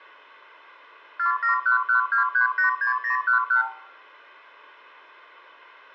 Multi-frequency trunk signalling (R2, with the far end's replies), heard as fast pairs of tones, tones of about 120 ms, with room echo. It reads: 47112386011